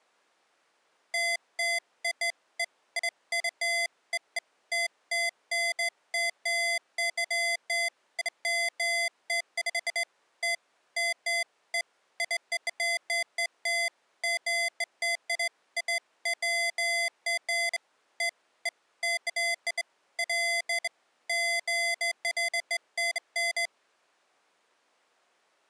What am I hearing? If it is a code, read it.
Beeps of irregular length. There is no code.